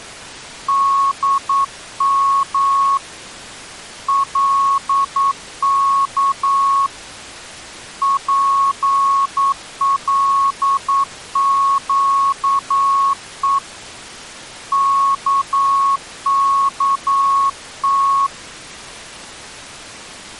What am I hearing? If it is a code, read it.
Morse code, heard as a keyed tone, hand-sent with a paddle, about 9 wpm, 1100 Hz. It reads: DM LK PLQE KKT